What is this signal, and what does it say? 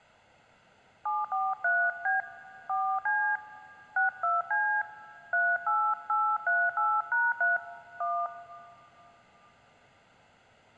DTMF, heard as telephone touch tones, dialled by hand, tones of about 220 ms, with room echo. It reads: 743B 4C 62C 38838#3 1